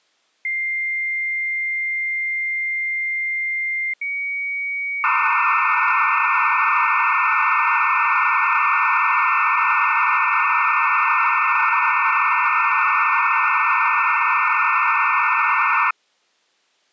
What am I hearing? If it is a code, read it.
Dial-up modem handshake (low-speed, two carriers), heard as two whistles, then hiss.